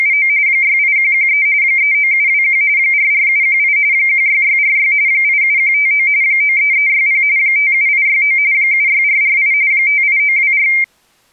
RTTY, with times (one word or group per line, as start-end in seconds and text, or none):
0.0-0.3 …
0.5-1.5 68113
1.6-2.6 39721
2.8-3.8 44718
3.9-4.9 16646
5.1-6.1 87159
6.2-7.2 93360
7.4-8.4 57869
8.5-9.5 76448
9.7-10.7 58924